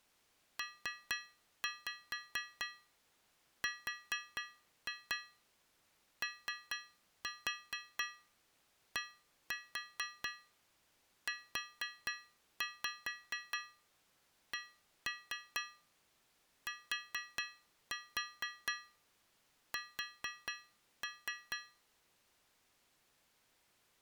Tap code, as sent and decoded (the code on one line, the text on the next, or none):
3-5 4-2 3-4 1-4 4-5 1-3 4-4 4-3
PRODUCTS